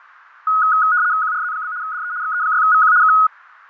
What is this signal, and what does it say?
RTTY (75 baud, 170 Hz shift), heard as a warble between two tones, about 1360 Hz centre, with radio static and fading. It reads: QRZ? DE XE6VQ K